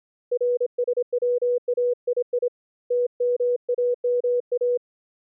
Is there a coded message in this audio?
Yes: Morse code (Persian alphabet) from 0.3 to 4.8 s, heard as a keyed tone, hand-sent with a paddle, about 26 wpm, 490 Hz. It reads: رسوایی تماما